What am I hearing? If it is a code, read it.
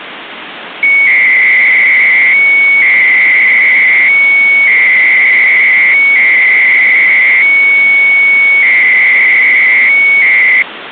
300-baud modem data (Bell 103 tones), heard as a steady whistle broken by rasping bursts, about 300 baud, 200 Hz shift, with phone line noise.